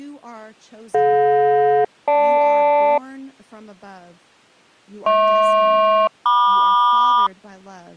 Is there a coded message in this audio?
Yes: aircraft SELCAL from 0.9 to 7.3 s, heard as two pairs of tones, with speech in English. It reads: DJ-GL HP-MQ